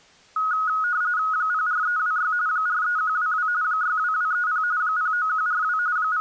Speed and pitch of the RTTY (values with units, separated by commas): 45.45 baud, 170 Hz shift, 1360 Hz centre